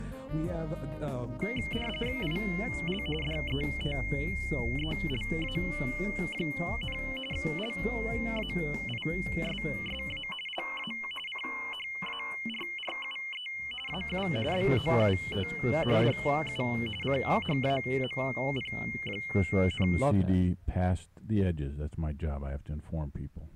RTTY (45.45 baud, 850 Hz shift), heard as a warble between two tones, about 2550 Hz centre. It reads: IL DETELA, LAISSA LA CHARRUE AU BOUT DU CHAMP,